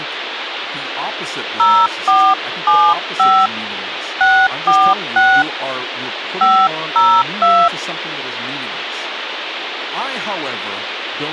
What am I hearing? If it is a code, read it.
DTMF, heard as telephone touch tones, dialled by hand, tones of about 260 ms, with phone line noise and speech in English. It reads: 0475 646 502